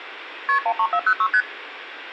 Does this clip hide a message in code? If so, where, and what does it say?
Yes: multi-frequency trunk signalling (R1, as on North American trunks) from 0.5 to 1.4 s, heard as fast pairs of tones, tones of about 70 ms, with room echo. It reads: KP 13406 ST